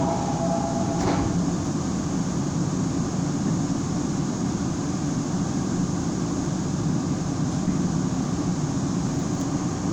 The noise inside a subway train. There is no code.